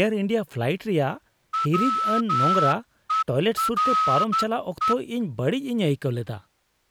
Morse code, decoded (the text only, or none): WERE